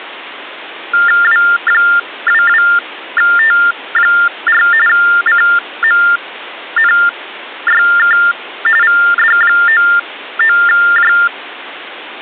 TTY/TDD text telephone tones (45.45 baud Baudot), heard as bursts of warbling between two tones, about 400 Hz shift, 1600 Hz centre. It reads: W22T4 CMNYK VD99J